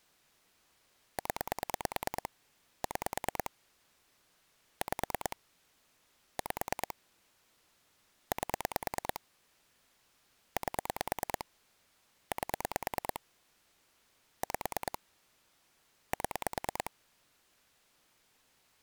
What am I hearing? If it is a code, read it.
Pulse dialling, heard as clicks on a phone line, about 9 pulses a second. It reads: 0 6 5 5 8 8 8 5 7